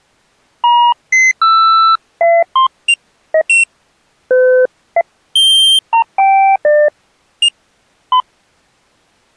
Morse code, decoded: none

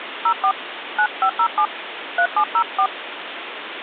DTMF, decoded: 04 9507 3704

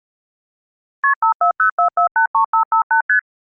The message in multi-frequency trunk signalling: KP 5404483558 ST

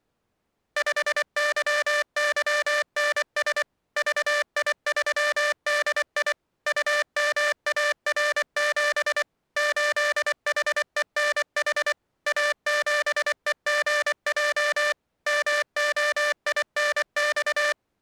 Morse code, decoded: 5YYNS VI3DI UMAR7 8HENH A7EGJ MOINX

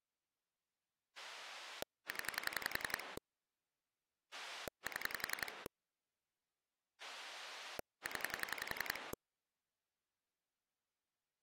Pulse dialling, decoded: 0 7 0

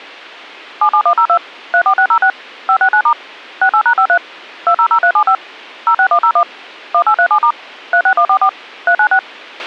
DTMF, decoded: 77102 34606 569* 68#53 200375 06101 1837* 36144 396

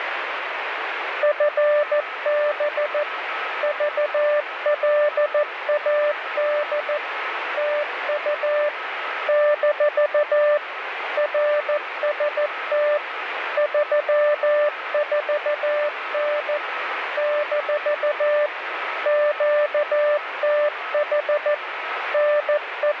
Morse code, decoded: FB VLAD TU - RST 34N - QTH …

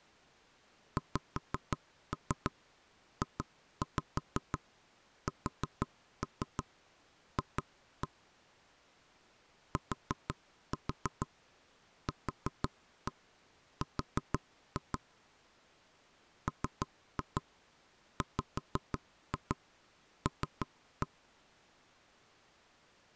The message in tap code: XJSF TQR MWL

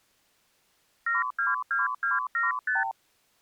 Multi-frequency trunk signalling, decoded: 722275

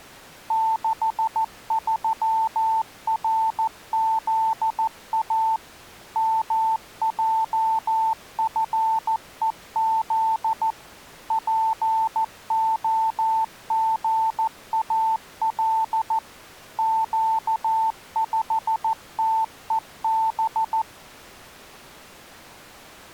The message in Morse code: 63RZA MJFEZ POGAL Q5TEB

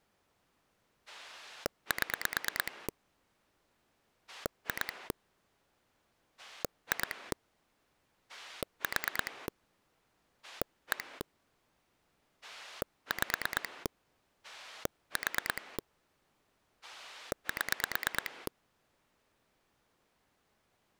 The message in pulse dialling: 7 2 2 4 1 5 4 7

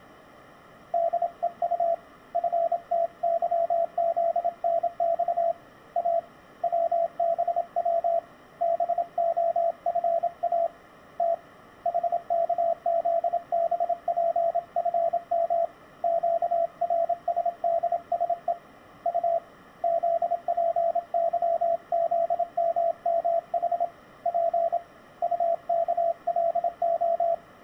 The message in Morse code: DEU FTYZNX A WBW BOFA T HKZBPFM QRSDSE U ZPYZMMH P UKLO

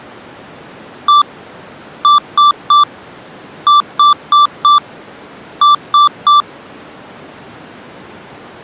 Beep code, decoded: 1-3-4-3

